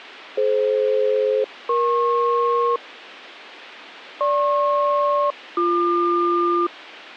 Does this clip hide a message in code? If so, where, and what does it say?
Yes: aircraft SELCAL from 0.4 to 6.7 s, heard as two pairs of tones. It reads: DF-EP GP-BQ